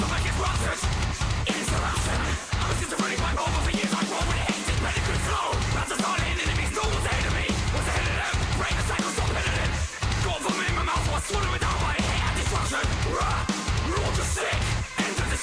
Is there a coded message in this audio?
No.